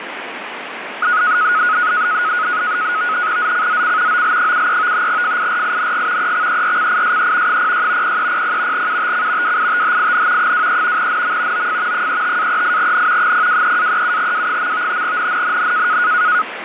NAVTEX (SITOR-B), 100 baud, 170 Hz shift, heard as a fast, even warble, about 1360 Hz centre, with radio static. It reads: ZCZC OL73 FIRING EXERCISE 06 0300 UTC WITHIN 23 NM OF 35-38N 023-37W. NNNN